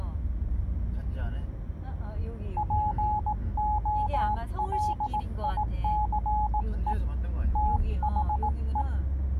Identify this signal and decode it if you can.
Morse code, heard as a keyed tone, hand-sent with a paddle, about 18 wpm, 840 Hz, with the noise inside a car. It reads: POLICE THE